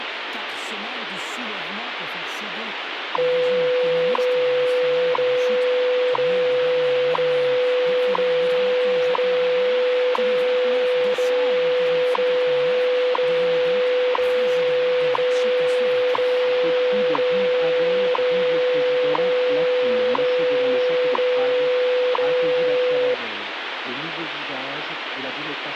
Radio time signal (WWV, Colorado), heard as ticks, one a second, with radio static.